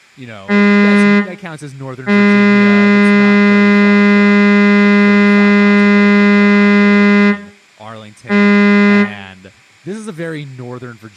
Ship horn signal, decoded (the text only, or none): 1 short, 1 long, 1 short